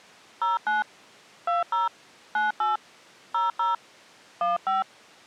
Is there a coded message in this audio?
Yes: DTMF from 0.4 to 4.8 s, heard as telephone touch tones, dialled by hand, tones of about 160 ms. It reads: 09 20 98 00 15